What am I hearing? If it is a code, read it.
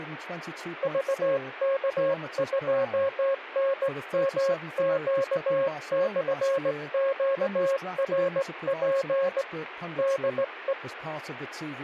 Morse code, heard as a keyed tone, hand-sent with a straight key, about 18 wpm, 540 Hz, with radio static. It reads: VK2NMQ/QRP DE